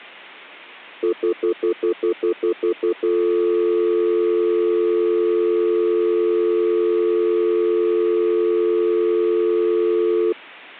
Telephone call progress tone (North American plan), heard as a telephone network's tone, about 350, 440 Hz, 0.1 s on and 0.1 s off. Stutter dial tone.